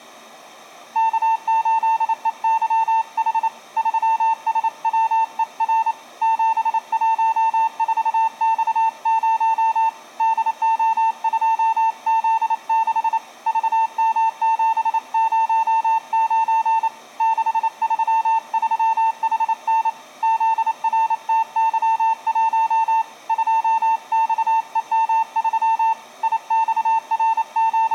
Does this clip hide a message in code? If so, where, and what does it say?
Yes: Morse code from 0.9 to 27.9 s, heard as a keyed tone, hand-sent with a paddle, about 28 wpm, 900 Hz. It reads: K8EYH 3SWER 714X0 DO2Z6 VM709 633HN ZRTY1 2XEM3 …